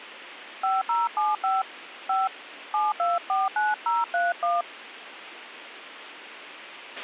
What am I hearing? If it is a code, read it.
DTMF, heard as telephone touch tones, dialled by hand, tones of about 180 ms, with radio hiss and a squelch burst at the end. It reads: 5075 5 7249031